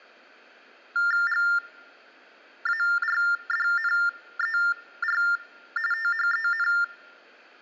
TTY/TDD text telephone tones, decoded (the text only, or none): GARDNER THEN